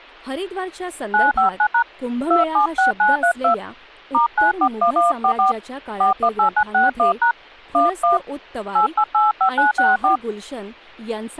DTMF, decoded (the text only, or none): 959# 276932 *941144 418961# 11 8885964